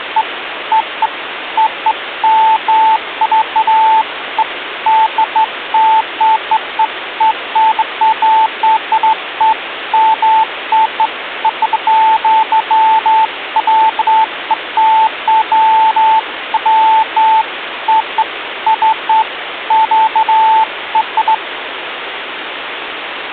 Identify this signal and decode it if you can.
Beeps of irregular length, with phone line noise. There is no code.